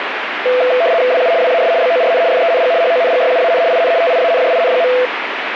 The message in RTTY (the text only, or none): WU WAS BORN FENG HONGYUAN IN TIANJIN.